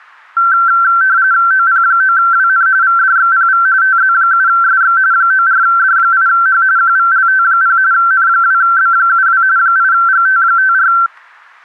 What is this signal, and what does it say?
RTTY (45.45 baud, 170 Hz shift), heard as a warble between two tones, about 1450 Hz centre, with static crashes. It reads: OP9WN VDXPV TZ7SX 94D8H QVLT0 N2B72 8GT54